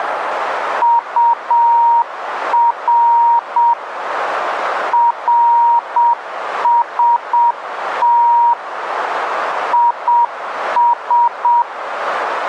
Morse code, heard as a keyed tone, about 7 wpm, 940 Hz, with radio static. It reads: UR RST IS